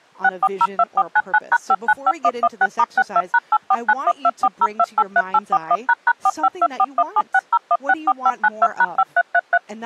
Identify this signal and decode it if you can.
DTMF, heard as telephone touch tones, dialled by machine, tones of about 50 ms, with speech in English. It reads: 6402499#595116*62#8491240283841##45241760164592#5333